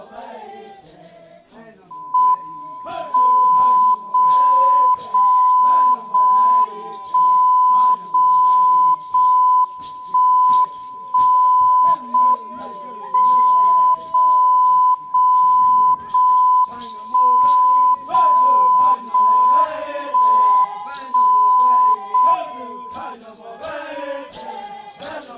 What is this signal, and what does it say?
Radio time signal (JJY), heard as a tone whose level steps once a second, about 1000 Hz. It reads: M 0 0 0 1 0 0 1 1 0 M 0 0 0 1 0 0 1 1 0 M